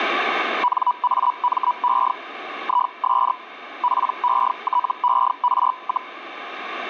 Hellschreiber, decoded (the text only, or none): NAME IS PETER,